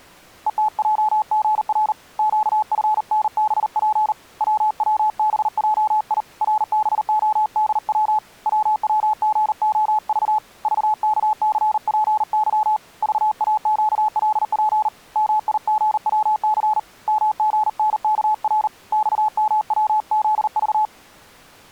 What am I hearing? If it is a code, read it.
Morse code, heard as a keyed tone, hand-sent with a paddle, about 39 wpm, 860 Hz. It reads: ETJGR QFNBP WWBJI RBODW WWGOV VKCPY VAQLP MIGWC MGNKR XMWZV